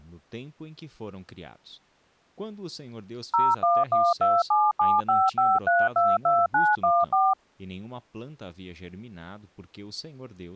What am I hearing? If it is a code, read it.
DTMF, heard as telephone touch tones, dialled by machine, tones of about 210 ms, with speech in Portuguese. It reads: 01127755322914